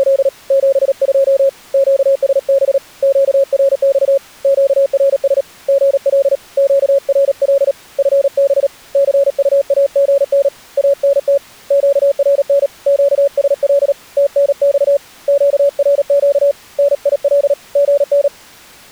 Morse code, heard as a keyed tone, hand-sent with a paddle, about 37 wpm, 560 Hz. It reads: … 72 QSB QRX QRS GL QRL FB CUAGN ANT QRN QSL TNX QRQ NIL GN